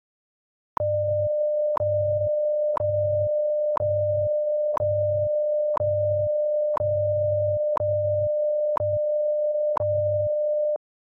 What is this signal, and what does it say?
Radio time signal (WWV, Colorado), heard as ticks, one a second.